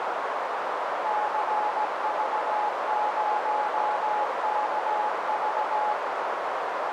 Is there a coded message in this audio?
Yes: Morse code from 1.0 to 6.0 s, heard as a keyed tone, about 17 wpm, 840 Hz, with heavy radio static and a narrow filter. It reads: CV0KV